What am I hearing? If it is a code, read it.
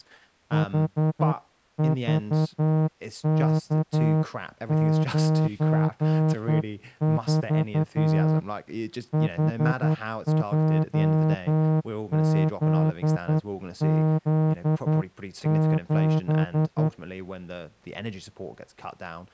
Morse code, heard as a horn, hand-sent with a straight key, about 10 wpm, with speech in English. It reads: HVK94 HJZZ7